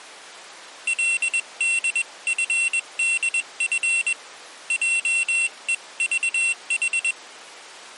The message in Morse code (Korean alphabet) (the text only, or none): 그는 하루